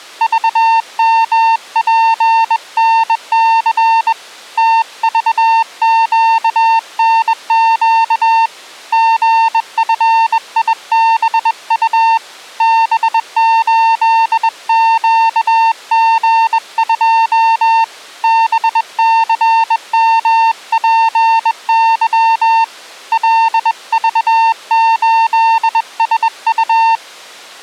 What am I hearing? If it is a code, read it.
Morse code, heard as a keyed tone, hand-sent with a bug key, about 21 wpm, 900 Hz. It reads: VMPNC TVQNQ GFIBU B8QG2 BCMPY LV8SU